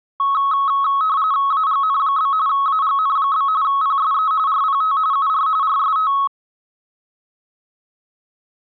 RTTY (45.45 baud, 170 Hz shift), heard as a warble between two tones, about 1190 Hz centre. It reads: AGN? AGN? PSE RPT UR RST